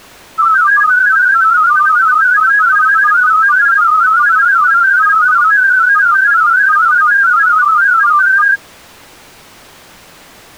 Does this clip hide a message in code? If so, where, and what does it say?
Yes: multi-tone FSK (Olivia or MFSK type), about 500 Hz wide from 0.4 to 8.6 s, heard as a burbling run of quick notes, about 31.25 baud.